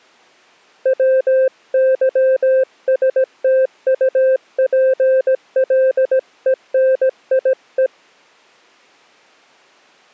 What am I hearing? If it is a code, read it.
Morse code (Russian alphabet), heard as a keyed tone, hand-sent with a paddle, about 17 wpm, 520 Hz. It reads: ВЫСТУПЛЕНИЕ